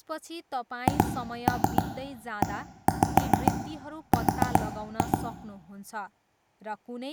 Tap code, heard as taps on a table, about 7 knocks a second, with room echo and speech in Nepali. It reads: HER